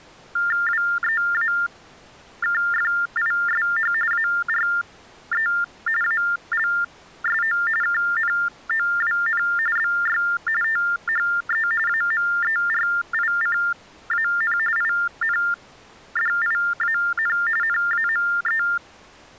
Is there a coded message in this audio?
Yes: TTY/TDD text telephone tones (45.45 baud Baudot) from 0.4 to 18.8 s, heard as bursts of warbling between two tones, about 400 Hz shift, 1600 Hz centre. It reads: WEAKFISH ARE ALSO KNOWN BY THE AMERICAN INDIAN NAME